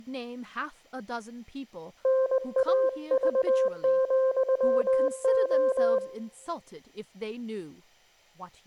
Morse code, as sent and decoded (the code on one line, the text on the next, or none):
-. .- ...- --..-- ---
NAV,O